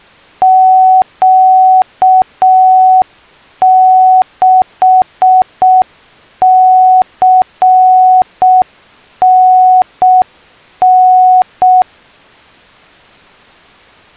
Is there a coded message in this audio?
Yes: Morse code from 0.4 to 11.9 s, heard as a keyed tone, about 6 wpm, 740 Hz. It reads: Q6CNN